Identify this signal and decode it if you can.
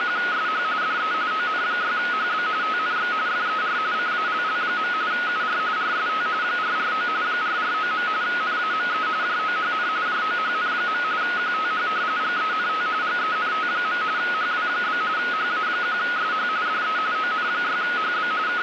RTTY (45.45 baud, 170 Hz shift), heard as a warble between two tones, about 1360 Hz centre, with radio static. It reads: … DE ON6HB TNX FER CALL. UR RST 449 449. NAME JOHN JOHN. QTH GENT GENT. HW? HA1SH DE ON6HB …